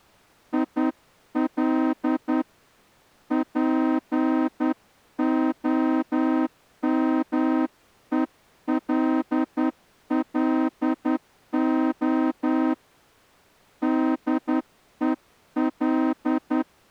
Morse code, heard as a horn, hand-sent with a straight key, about 10 wpm. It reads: IL POMELLO DEL